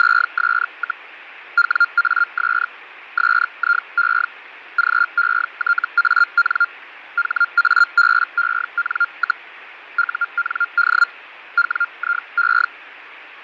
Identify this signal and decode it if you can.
Hellschreiber (Feld-Hell, 122.5 baud), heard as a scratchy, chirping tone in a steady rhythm, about 1400 Hz, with radio static and fading. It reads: … WAS SIE GETAN HABEN, UND WIE